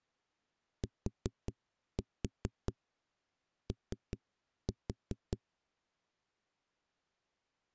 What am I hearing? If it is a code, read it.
Tap code, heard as knocks on a wall, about 4 knocks a second. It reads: TO